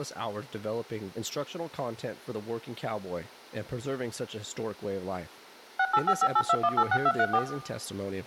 DTMF, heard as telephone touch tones, dialled by machine, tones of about 60 ms, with room echo and speech in English. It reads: 685582186234